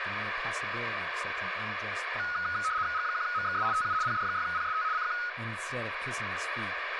RTTY (75 baud, 170 Hz shift), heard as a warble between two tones, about 1360 Hz centre, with radio static and speech in English. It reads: G1MXS TU PD6PST CQ